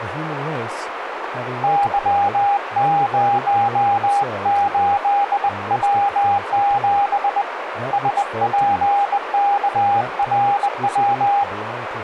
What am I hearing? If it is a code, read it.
Morse code, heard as a keyed tone, hand-sent with a bug key, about 20 wpm, 810 Hz, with radio static, a narrow filter and speech in English. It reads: Y08W7 SPKRW